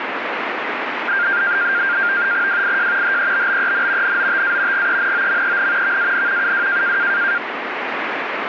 NAVTEX (SITOR-B), 100 baud, 170 Hz shift, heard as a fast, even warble, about 1500 Hz centre, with radio static. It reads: WIJ HEBBEN NOTA GENOMEN VAN UW